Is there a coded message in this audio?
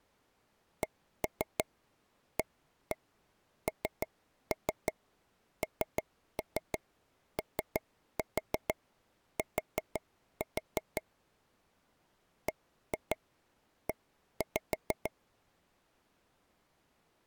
Yes: tap code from 0.8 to 15.1 s, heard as taps on a table, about 6 knocks a second. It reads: CANNOT BE